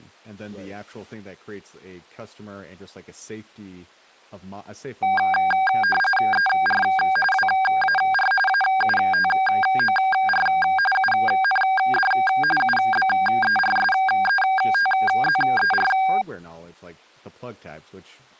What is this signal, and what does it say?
RTTY (45.45 baud, 850 Hz shift), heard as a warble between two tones, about 1190 Hz centre, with speech in English. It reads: ER WAR AUTOR UND UBERSETZER